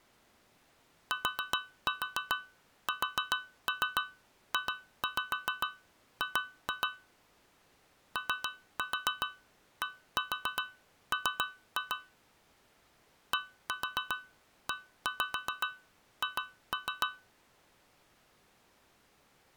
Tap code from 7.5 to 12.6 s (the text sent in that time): ODM